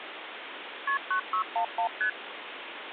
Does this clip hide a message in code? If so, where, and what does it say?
Yes: multi-frequency trunk signalling (R1, as on North American trunks) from 0.9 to 2.1 s, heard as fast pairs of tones, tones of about 90 ms, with phone line noise. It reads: KP 9611 ST